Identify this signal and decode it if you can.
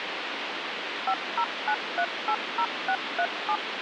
DTMF, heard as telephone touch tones, dialled by machine, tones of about 70 ms, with phone line noise. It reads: 509380637